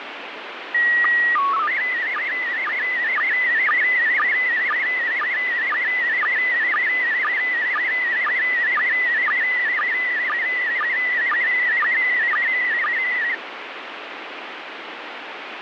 SSTV (slow-scan television), PD 120, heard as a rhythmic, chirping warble, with radio static.